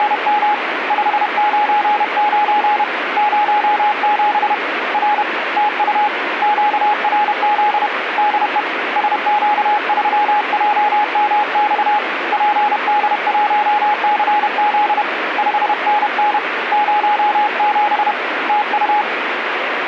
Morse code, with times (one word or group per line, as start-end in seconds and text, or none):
0.0-0.5 …
0.9-2.8 599
3.2-4.5 07
4.9-5.2 R
5.6-6.1 TU
6.4-7.9 QRZ
8.2-8.6 DE
9.0-12.0 SQ3JMX
12.3-15.0 PD1CZ
15.4-16.4 5NN
16.7-18.1 07
18.5-19.0 TU